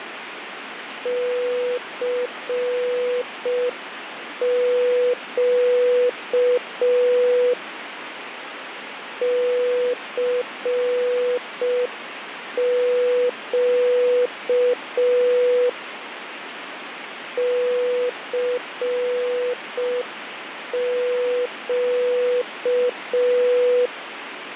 Morse code, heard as a keyed tone, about 5 wpm, 490 Hz, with radio static. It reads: CQ CQ CQ